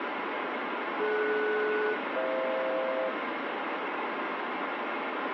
Aircraft SELCAL, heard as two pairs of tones, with heavy radio static and room echo. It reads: DS-FH